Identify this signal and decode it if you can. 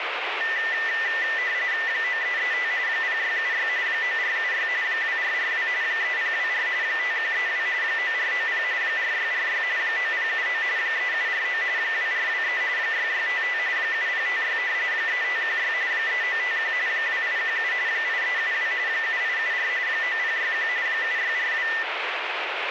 RTTY (45.45 baud, 170 Hz shift), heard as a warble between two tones, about 1900 Hz centre, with radio static. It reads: 9335 0676 9476 2442 3024 5132 9490 4646 9079 3749 2423 6655 7056 3516 3951 2817 8372 7874 9061 7642